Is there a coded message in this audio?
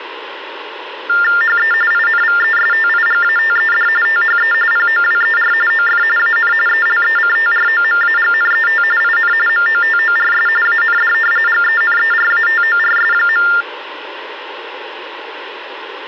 Yes: TTY/TDD text telephone tones (45.45 baud Baudot) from 1.1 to 13.6 s, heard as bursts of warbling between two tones, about 400 Hz shift, 1600 Hz centre, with phone line noise. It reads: HE INVESTIGATED THE POWER OF AN ELECTROMAGNET IN MOTORS AND GENERATORS.